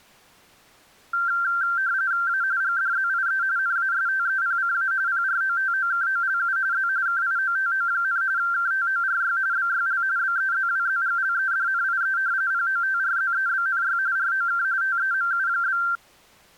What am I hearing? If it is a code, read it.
RTTY (45.45 baud, 170 Hz shift), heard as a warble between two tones, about 1470 Hz centre. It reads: A GDZIE NASTEPCA PROTOKOLU Z KIOTO, KTORY BYL BEZWZGLEDNIE POTRZEBNY ROK TEMU?